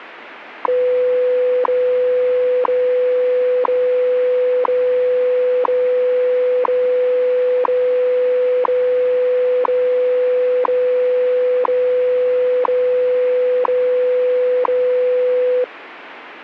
Radio time signal (WWV, Colorado), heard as ticks, one a second, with radio static.